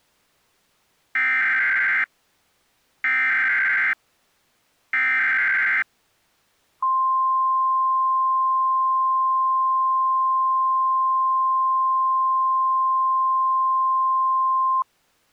Emergency Alert System (SAME) tones (header bursts, then the 1050 Hz attention tone), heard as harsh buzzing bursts, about 520.83 baud.